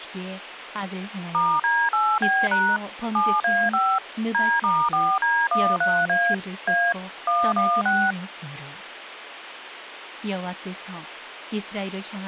DTMF, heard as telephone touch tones, dialled by machine, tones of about 250 ms, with phone line noise and speech in Korean. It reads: *D8B# 7A5 D*4D13A A 116